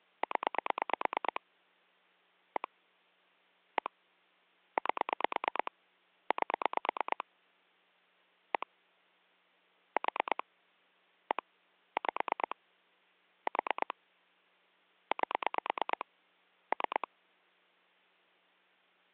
Pulse dialling, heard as clicks on a phone line, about 9 pulses a second. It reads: 0 1 1 8 8 1 4 1 5 4 8 3